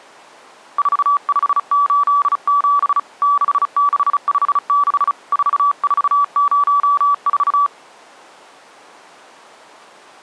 Morse code, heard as a keyed tone, hand-sent with a bug key, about 35 wpm, 1150 Hz. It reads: 4587 6656 4404